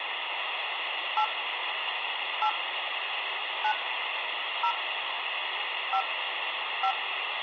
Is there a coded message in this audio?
Yes: DTMF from 1.2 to 6.9 s, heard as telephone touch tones, dialled by hand, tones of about 80 ms, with phone line noise. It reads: 8 8 9 0 5 5